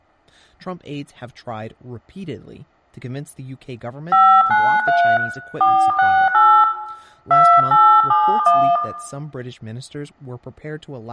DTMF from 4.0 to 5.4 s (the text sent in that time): 593